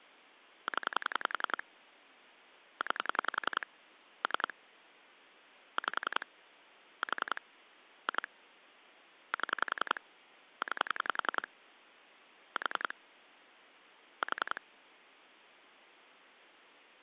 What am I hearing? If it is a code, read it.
Pulse dialling, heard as clicks on a phone line, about 10 pulses a second. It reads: 0 9 3 5 4 2 7 9 4 4